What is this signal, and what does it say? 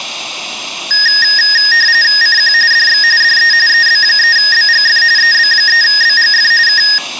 RTTY (45.45 baud, 170 Hz shift), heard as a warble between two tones, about 1750 Hz centre. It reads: CQ DX DE EB3BGF EB3BGF K